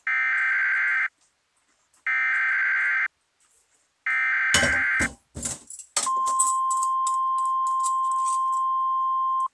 Emergency Alert System (SAME) tones (header bursts, then the 1050 Hz attention tone), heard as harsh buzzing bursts, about 520.83 baud, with kitchen noise.